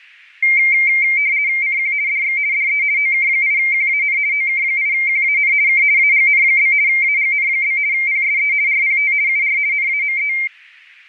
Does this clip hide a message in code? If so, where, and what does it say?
Yes: RTTY (50 baud, 170 Hz shift) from 0.4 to 10.5 s, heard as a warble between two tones, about 2200 Hz centre. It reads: CQ DX DE OK8QAN OK8QAN K AGN? AGN? PSE RPT UR NAME